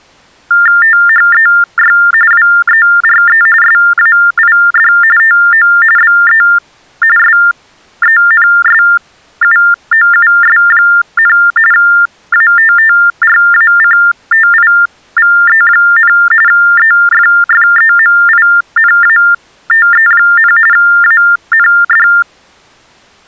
TTY/TDD text telephone tones (45.45 baud Baudot), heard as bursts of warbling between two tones, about 400 Hz shift, 1600 Hz centre. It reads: THEY WERE SAID TO BE SENSUOUS, ATTRACTIVE, EFFEMINATE, AND